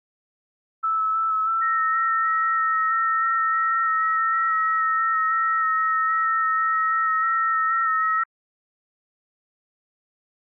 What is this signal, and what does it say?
FT8 (several signals at once), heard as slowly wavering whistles, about 6.25 baud.